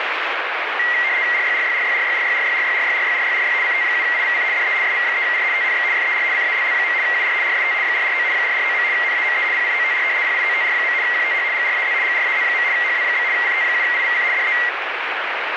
RTTY (75 baud, 170 Hz shift), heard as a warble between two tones, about 2000 Hz centre, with radio static. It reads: RYRYRYRYRYRYRYRYRYRYRY CT7IVC DE SV3R TNX FER CALL. UR RST 449 449. NAME PIOTR PIOTR. QTH GRAZ GRAZ. HW? CT7IVC DE